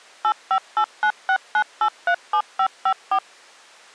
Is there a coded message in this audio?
Yes: DTMF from 0.2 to 3.2 s, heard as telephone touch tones, dialled by machine, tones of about 70 ms. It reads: 858969837554